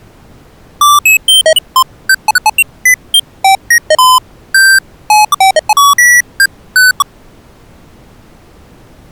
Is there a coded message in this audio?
No, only electronic bleeps of random pitch and length.